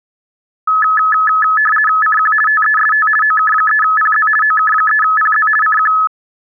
RTTY (50 baud, 450 Hz shift), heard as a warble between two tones, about 1500 Hz centre. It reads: CQ TEST OK3PZ OK3PZ CQ